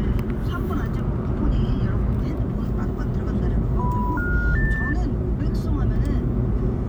Telephone call progress tone (North American plan), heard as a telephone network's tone, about 980, 1430, 1800 Hz, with the noise inside a car. Special information tone.